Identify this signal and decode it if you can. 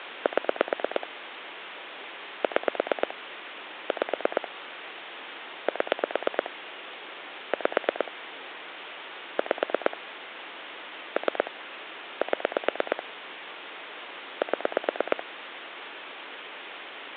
Pulse dialling, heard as clicks on a phone line, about 8 pulses a second, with phone line noise. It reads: 7 6 5 7 5 5 3 7 7